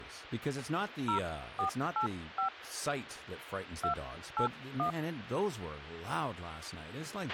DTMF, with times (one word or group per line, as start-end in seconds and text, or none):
1.1-2.5 0485
3.8-4.9 281